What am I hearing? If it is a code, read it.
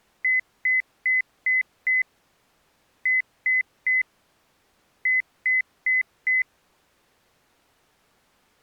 Beep code, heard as beeps, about 2050 Hz. 5-3-4.